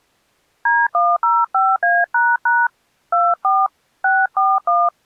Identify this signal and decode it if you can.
DTMF, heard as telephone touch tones, dialled by hand, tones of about 220 ms. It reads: D105A## 24 641